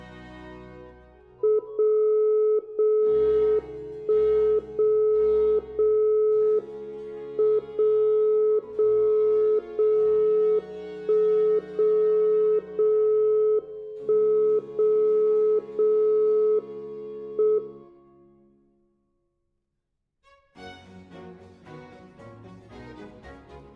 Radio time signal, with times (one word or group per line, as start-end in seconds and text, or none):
1.6-2.6 0
2.6-3.6 0
3.6-4.6 1
4.6-5.6 0
5.6-6.6 0
6.6-7.6 M
7.6-8.6 0
8.6-9.6 0
9.6-10.6 0
10.6-11.6 1
11.6-12.6 0
12.6-13.6 0
13.6-14.6 1
14.6-15.6 0
15.6-16.6 0
16.6-17.6 M